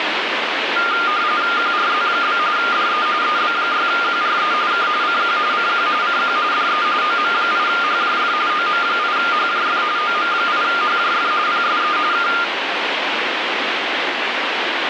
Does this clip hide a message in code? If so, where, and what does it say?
Yes: RTTY (45.45 baud, 170 Hz shift) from 0.8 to 12.4 s, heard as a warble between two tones, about 1300 Hz centre, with radio static. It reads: QRZ? DE EB6QRE K CQ CQ CQ DE OM8HJF OM8HJF OM8HJF PSE K